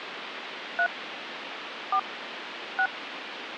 DTMF, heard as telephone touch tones, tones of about 70 ms, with phone line noise. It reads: 3 4 6